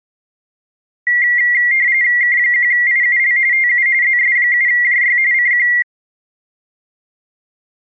RTTY (45.45 baud, 170 Hz shift), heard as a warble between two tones, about 2050 Hz centre. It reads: K1IUL TU ZS7JY CQ